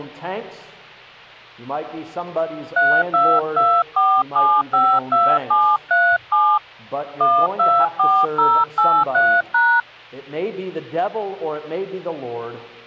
DTMF, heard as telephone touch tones, dialled by hand, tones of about 260 ms. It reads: 3224752737 124083#